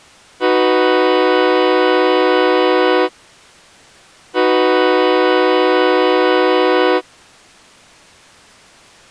Train horn signal, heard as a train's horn. 2 long. On North American railways: brakes released, proceed.